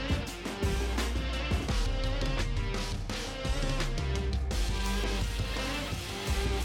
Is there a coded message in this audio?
No.